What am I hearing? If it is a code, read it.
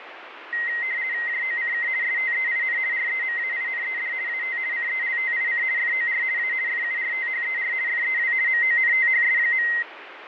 RTTY (50 baud, 170 Hz shift), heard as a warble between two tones, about 2000 Hz centre, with radio static and fading. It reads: JOCK STEIN REMAINED AT CELTIC FOR A FURTHER FEW MONTHS.